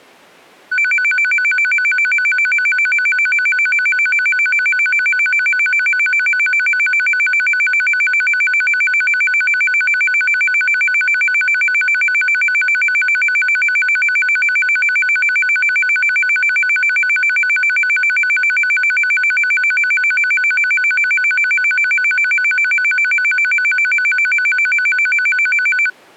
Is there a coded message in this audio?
No, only a tone that alternates evenly between two pitches.